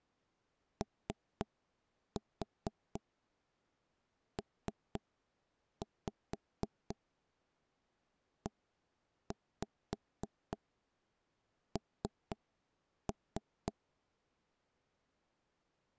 Tap code, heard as knocks on wood, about 4 knocks a second. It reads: OPEN